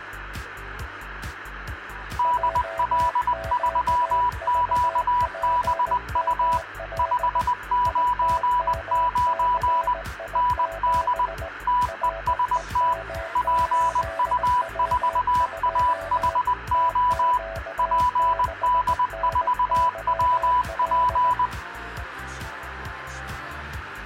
Morse code, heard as two keyed tones. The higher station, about 20 wpm, 990 Hz: DL3QBU 599 ND TEST PU4AHO PD4WP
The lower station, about 18 wpm, 660 Hz: JQVPML ITMCI7 REM8W2 TQ6NYL